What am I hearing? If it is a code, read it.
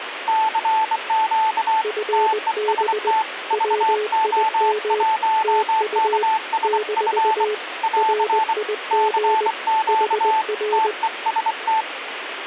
Morse code, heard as two keyed tones, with radio static. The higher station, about 24 wpm, 880 Hz: CQ TEST VO1KSF <AR> CQ TEST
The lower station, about 20 wpm, 420 Hz: FB WIM TU - RIG HR